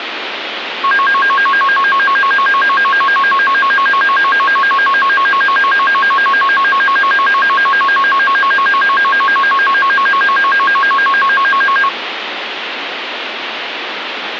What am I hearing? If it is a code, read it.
A tone that alternates evenly between two pitches, with radio static. There is no code.